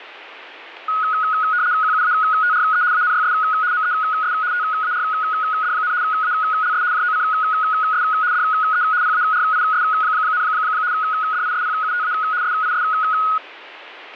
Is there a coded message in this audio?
Yes: RTTY (75 baud, 170 Hz shift) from 0.9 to 13.4 s, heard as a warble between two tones, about 1360 Hz centre. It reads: QUATRE ANYS MES TARD, ALS JOCS DE PARIS, DISPUTA SIS